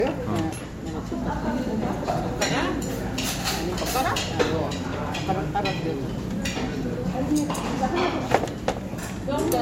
The noise of a restaurant. There is no code.